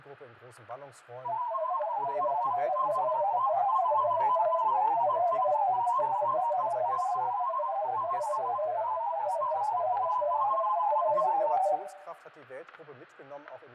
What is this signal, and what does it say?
Multi-tone FSK (Olivia or MFSK type), about 500 Hz wide, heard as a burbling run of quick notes, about 31.25 baud, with static crashes and room echo.